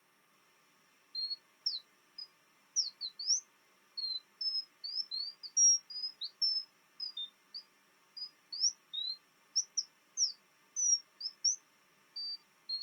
Bird-like chirps. There is no code.